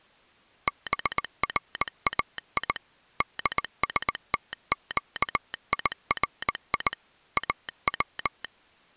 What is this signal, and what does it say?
Morse code (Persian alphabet), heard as a telegraph sounder, machine-sent, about 19 wpm. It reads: برای دستگیری او